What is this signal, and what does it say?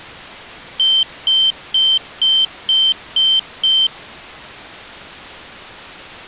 Beep code, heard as a piezo beeper, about 3100 Hz. 7 short. In AMI BIOS tables: virtual mode exception error; in Dell tables: processor failure.